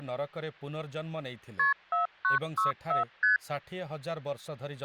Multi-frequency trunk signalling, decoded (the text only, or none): KP 4964 ST